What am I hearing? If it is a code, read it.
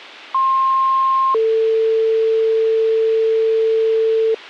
Two-tone page, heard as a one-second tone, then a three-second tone, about 1060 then 450 Hz.